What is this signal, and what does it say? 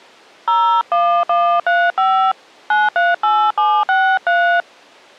DTMF, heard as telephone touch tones, dialled by hand, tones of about 270 ms. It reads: 01135 938763